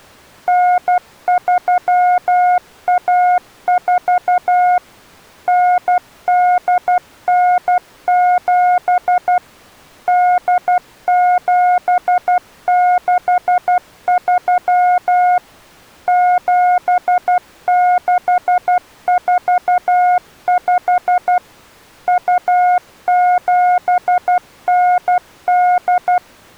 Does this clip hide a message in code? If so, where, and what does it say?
Yes: Morse code (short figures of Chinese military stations) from 0.4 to 26.2 s, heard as a keyed tone, machine-sent, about 12 wpm, 720 Hz. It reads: 9314 9897 8763 7645 2798